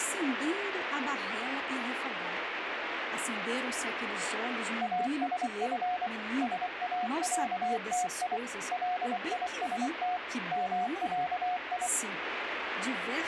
Morse code (Arabic alphabet), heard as a keyed tone, machine-sent, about 24 wpm, 720 Hz, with radio static and speech in Portuguese. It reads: اسف ساعتي ليست معي